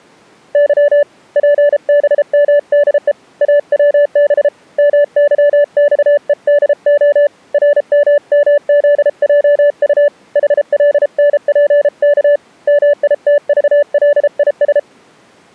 Morse code, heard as a keyed tone, hand-sent with a paddle, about 33 wpm, 580 Hz. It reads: Y PBMDE AWB MYXEDO RMMZJU HLNPK MITVLIS